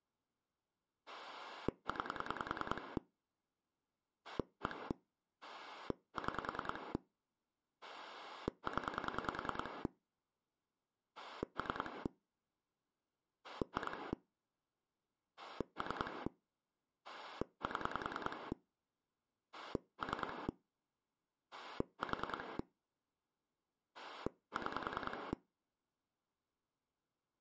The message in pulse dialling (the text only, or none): 9 1 6 0 3 2 3 7 3 4 6